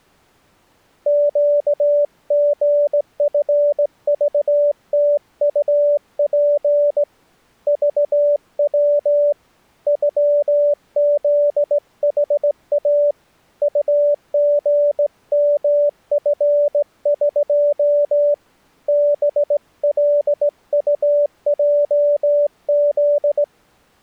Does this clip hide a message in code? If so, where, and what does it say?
Yes: Morse code (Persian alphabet) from 1.0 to 23.5 s, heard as a keyed tone, hand-sent with a straight key, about 17 wpm, 580 Hz. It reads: گژفذتطپ ذو غزحا طژمفق بلطجز